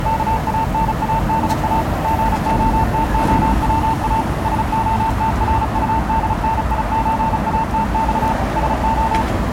Morse code (Russian alphabet), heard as a keyed tone, machine-sent, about 35 wpm, 900 Hz, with street noise. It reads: КАНАДА ГОТОВА СОТРУДНИЧАТЬ СО